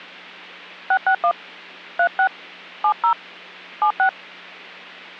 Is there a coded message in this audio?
Yes: DTMF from 0.9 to 4.1 s, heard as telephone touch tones, dialled by hand, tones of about 80 ms. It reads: 661 36 70 76